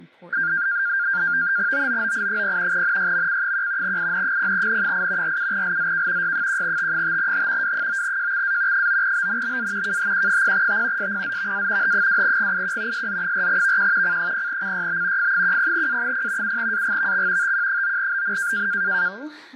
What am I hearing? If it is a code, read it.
NAVTEX (SITOR-B), 100 baud, 170 Hz shift, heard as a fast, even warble, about 1500 Hz centre, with fading and speech in English. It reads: OOOI0 NYMC1 IN0N8 47LZK Y1T5H W9JXA 9BNBA KHQ0T SPZVA H2GIQ SZ4VQ C0CYB F10A0 7AGVX TQ9BN